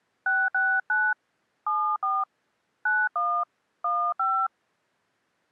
DTMF, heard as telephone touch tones, dialled by hand, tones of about 270 ms. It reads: 669 74 91 15